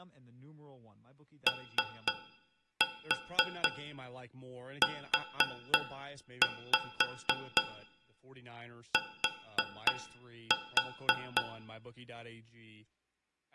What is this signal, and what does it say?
Tap code, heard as taps on a metal pipe, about 3 knocks a second, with room echo and speech in English. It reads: OUT